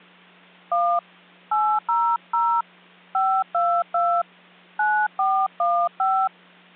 DTMF, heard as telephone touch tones, dialled by hand, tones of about 280 ms, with hum. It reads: 1 800 522 9415